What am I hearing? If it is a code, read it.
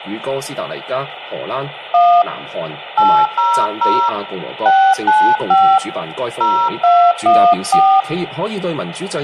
DTMF, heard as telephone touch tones, dialled by hand, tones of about 280 ms, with phone line noise. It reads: 1 800 695 0214